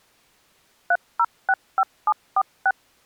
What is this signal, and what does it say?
DTMF, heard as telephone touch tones, dialled by machine, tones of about 50 ms. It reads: 3065746